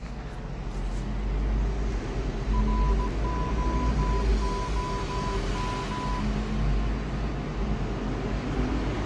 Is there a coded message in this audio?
Yes: Morse code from 2.5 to 6.3 s, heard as a keyed tone, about 17 wpm, 1000 Hz, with street noise. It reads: ROOM